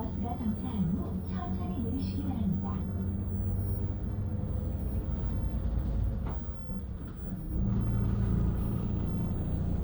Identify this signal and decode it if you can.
The noise inside a bus. There is no code.